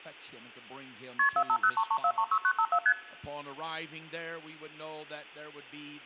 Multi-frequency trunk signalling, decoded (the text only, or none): KP 45033436954 ST